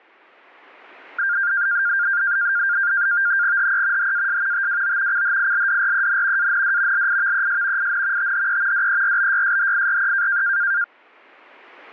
NAVTEX (SITOR-B), 100 baud, 170 Hz shift, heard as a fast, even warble, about 1500 Hz centre. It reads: HE HAS TWO CHILDREN AND LIVES IN THE DERBYSHIRE